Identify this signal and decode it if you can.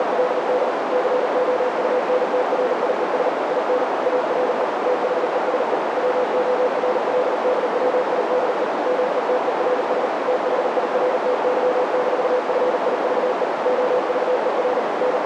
Morse code, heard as a keyed tone, machine-sent, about 39 wpm, 500 Hz, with heavy radio static and a narrow filter. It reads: … COUNTRIES IN ARE THESE WORLDWIDE METERS THIRTY-FIVE OVER …